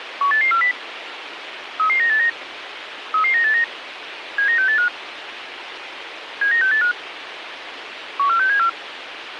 Five-tone selective call (CCIR), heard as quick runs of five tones, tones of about 100 ms, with radio hiss. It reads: 18840 33989 33989 79685 79685 14674